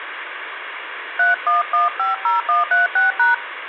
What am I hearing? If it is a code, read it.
DTMF, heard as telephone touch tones, dialled by hand, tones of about 150 ms, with phone line noise. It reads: 31150136#